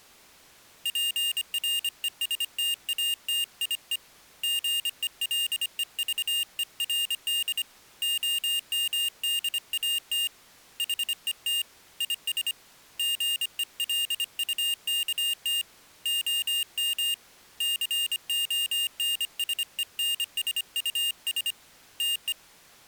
Morse code, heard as a high beeper, hand-sent with a paddle, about 25 wpm, 2800 Hz. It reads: PRESTATIE GELEVERD OMDAT HET IS GELUKT OM CONSENSUS TE